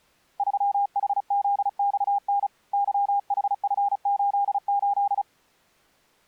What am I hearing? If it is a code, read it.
Morse code, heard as a keyed tone, hand-sent with a paddle, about 35 wpm, 810 Hz. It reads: 3HZXN YHF88